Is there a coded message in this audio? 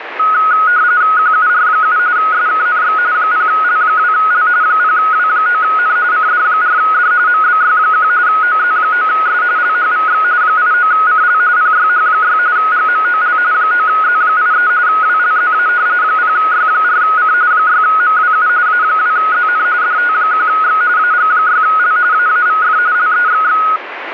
Yes: RTTY (45.45 baud, 170 Hz shift) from 0.2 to 23.8 s, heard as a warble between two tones, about 1360 Hz centre, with radio static. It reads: QUR7 SKNX 0L2L 0W9N CD4D MBY1 OZ9S LHVX 89CL PYH6 GMOL 9Z83 WLZA 0Y4C 6MWU A2ZN DT1X AG6L AAVF LEXX